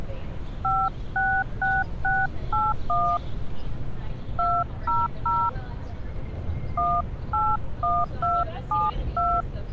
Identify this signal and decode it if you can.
DTMF, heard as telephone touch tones, dialled by hand, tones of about 200 ms, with street noise. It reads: 566681 200 181272